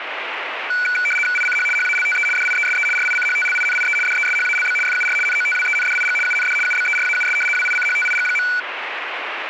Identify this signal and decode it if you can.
RTTY (75 baud, 850 Hz shift), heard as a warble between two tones, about 1900 Hz centre, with radio static. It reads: ICH HALTE DIESE RICHTLINIE DESHALB FUR NOTWENDIG UND UBERAUS WICHTIG.